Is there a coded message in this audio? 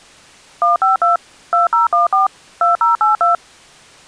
Yes: DTMF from 0.6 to 3.3 s, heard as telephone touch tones, dialled by machine, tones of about 140 ms. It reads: 152 2014 2082